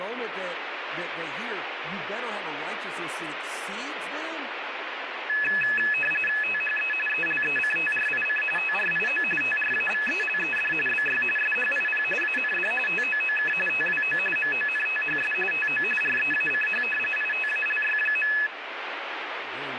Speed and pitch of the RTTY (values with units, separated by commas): 45.45 baud, 850 Hz shift, 2150 Hz centre